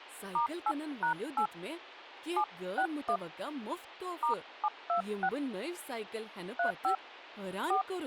DTMF, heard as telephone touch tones, dialled by hand, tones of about 80 ms, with speech in Kashmiri. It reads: *8#8 761 *726 35 4